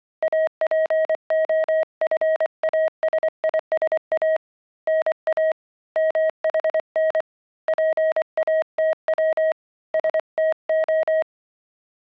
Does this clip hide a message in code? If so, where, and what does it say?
Yes: Morse code (Greek alphabet) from 0.2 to 11.3 s, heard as a keyed tone, hand-sent with a paddle, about 24 wpm, 630 Hz. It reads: ΑΠΟΦΑΣΙΣΑ ΝΑ ΜΗΝ ΠΑΤΩ ΣΤΟ